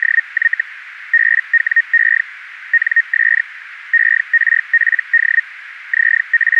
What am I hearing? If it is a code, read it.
Hellschreiber (Feld-Hell, 122.5 baud), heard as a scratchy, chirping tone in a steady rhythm, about 1850 Hz, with radio static. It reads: … BWE NS ERPD …